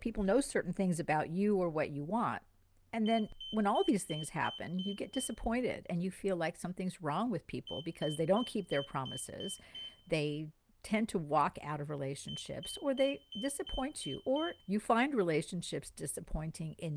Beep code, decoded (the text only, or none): 7 short